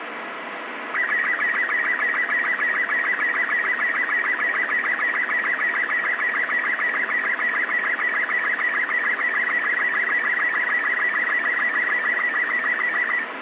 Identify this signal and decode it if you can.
SSTV (slow-scan television), Robot 36, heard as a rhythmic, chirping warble, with radio static.